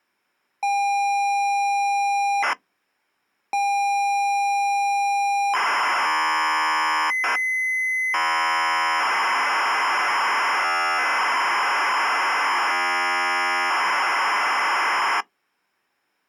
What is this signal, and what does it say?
ZX Spectrum tape loading, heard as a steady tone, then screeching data.